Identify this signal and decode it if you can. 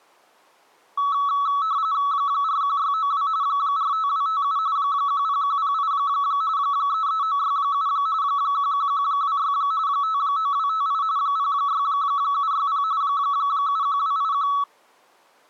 RTTY (45.45 baud, 170 Hz shift), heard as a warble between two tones, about 1220 Hz centre. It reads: 41692 45257 10108 33967 11126 59258 06760 71281